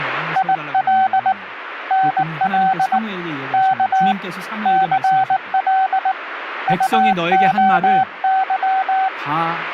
Morse code, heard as a keyed tone, hand-sent with a paddle, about 19 wpm, 760 Hz, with radio static and speech in Korean. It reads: IL NL K CL UOY